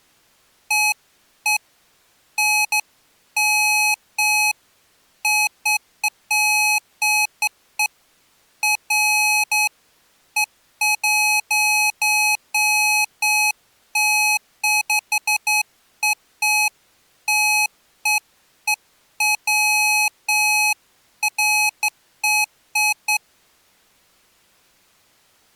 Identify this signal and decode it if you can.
Beeps of irregular length. There is no code.